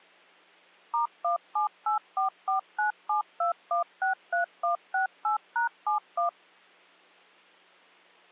DTMF, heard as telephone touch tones, dialled by machine, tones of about 120 ms. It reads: *17844972163168#71